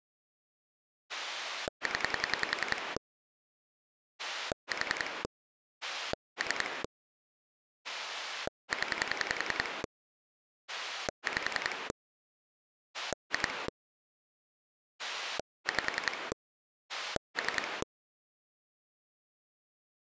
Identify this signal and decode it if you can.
Pulse dialling, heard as a rotary dial, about 10 pulses a second. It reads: 0 4 3 0 5 2 5 3